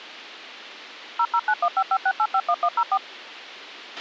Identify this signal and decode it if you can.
DTMF, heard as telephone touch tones, dialled by machine, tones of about 60 ms, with a squelch burst at the end. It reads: 0091556851104